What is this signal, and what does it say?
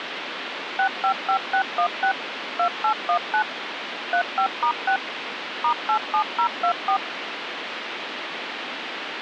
DTMF, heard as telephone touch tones, dialled by machine, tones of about 90 ms, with phone line noise. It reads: 655616 2819 35*6 *87024